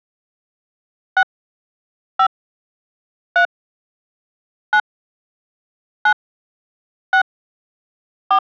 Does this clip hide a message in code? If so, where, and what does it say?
Yes: DTMF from 1.2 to 8.4 s, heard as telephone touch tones, dialled by hand, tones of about 80 ms. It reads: 6 5 3 9 9 6 4